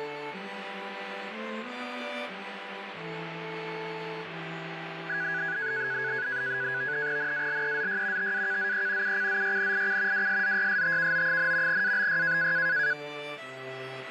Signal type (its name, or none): NAVTEX (SITOR-B)